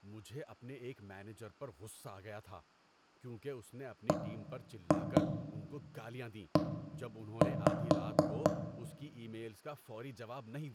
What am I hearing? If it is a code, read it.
Tap code, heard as knocks on wood, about 4 knocks a second, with room echo and speech in Urdu. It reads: BE